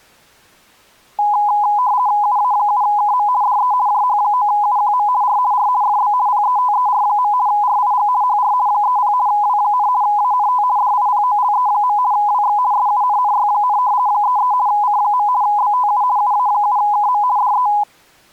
RTTY (50 baud, 170 Hz shift), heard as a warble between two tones, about 910 Hz centre. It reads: UA7KM DE JH9UQM R R FB PETER. RIG HR 30 W, ANT DIPOLE. WX SUNNY, 33 C. BTU UA7KM DE